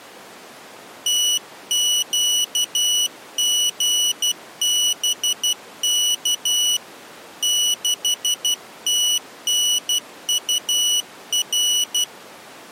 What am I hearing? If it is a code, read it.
Morse code, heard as a high beeper, hand-sent with a paddle, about 12 wpm, 2950 Hz. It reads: TQGBK 6TNUR